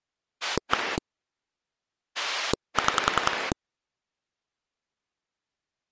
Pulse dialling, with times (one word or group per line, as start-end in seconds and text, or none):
0.4-1.0 1
2.2-3.5 6